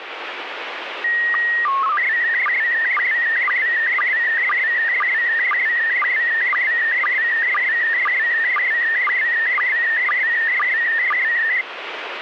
SSTV (slow-scan television), PD 120, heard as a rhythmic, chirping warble, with radio static.